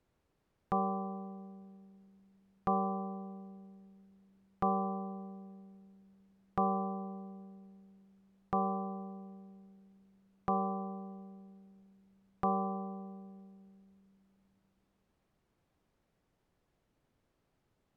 Clock strike, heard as a bell. 7. Seven o'clock.